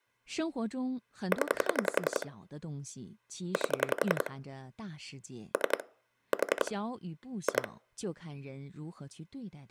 Pulse dialling, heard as clicks on a phone line, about 11 pulses a second, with speech in Chinese. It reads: 0 8 3 4 2